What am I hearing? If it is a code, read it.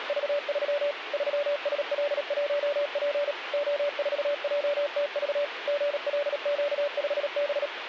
Morse code, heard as a keyed tone, machine-sent, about 37 wpm, 580 Hz, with radio static. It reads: … 3SL1P O4JTV GLQ5B